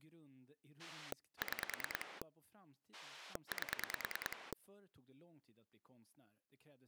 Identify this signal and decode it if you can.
Pulse dialling, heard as a rotary dial, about 9 pulses a second, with speech in Swedish. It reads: 6 8